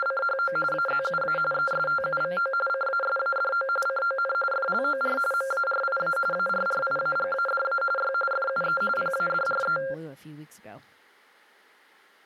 RTTY (45.45 baud, 850 Hz shift), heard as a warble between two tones, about 960 Hz centre, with speech in English. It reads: … AZUA ESTUVO CASADO CON FLOR MARIA ARRIAGADA Y FUE PADRE